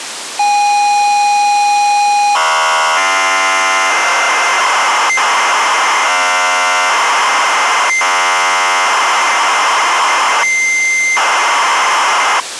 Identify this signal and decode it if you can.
ZX Spectrum tape loading, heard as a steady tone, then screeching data, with tape hiss.